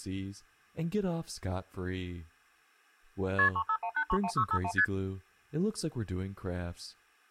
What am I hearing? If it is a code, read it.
Multi-frequency trunk signalling (R1, as on North American trunks), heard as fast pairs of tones, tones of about 70 ms, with speech in English. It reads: KP 351831651 ST